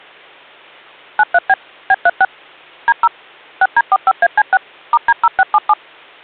DTMF, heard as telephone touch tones, dialled by machine, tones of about 40 ms. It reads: 93B B36 D0 6D45AC6 *D0677